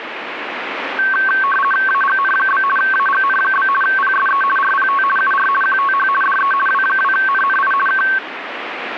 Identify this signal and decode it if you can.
RTTY (50 baud, 450 Hz shift), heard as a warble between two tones, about 1330 Hz centre, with radio static. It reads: AGN? AGN? PSE RPT UR QTH DE W2NNI K